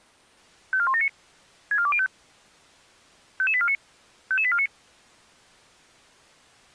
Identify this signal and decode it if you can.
Five-tone selective call (ZVEI), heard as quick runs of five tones, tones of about 70 ms. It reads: 54179 64205 55849 55849